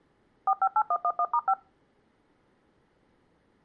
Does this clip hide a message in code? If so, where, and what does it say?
Yes: DTMF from 0.5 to 1.5 s, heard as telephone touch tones, dialled by machine, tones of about 60 ms. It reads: 458111*5